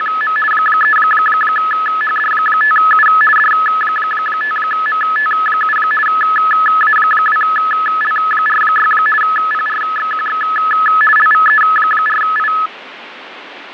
RTTY (50 baud, 450 Hz shift), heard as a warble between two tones, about 1500 Hz centre, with radio static and fading. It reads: … 3HD5U D5MT7 A2L46 PRXQX LVE4I